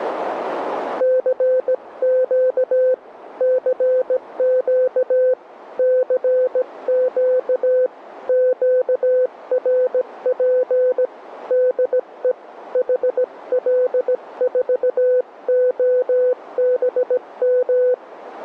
Morse code, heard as a keyed tone, hand-sent with a bug key, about 17 wpm, 510 Hz, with radio static. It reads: CQ CQ CQ QRP DE HL4OBM